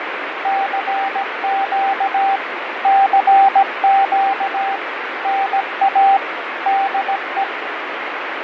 Morse code, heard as a keyed tone, machine-sent, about 17 wpm, 780 Hz, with radio static and fading. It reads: CQ CQ NA DE